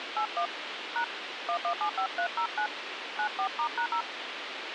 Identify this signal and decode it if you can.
DTMF, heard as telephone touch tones, dialled by hand, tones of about 90 ms, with radio hiss. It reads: 81 # 1175309 94*#0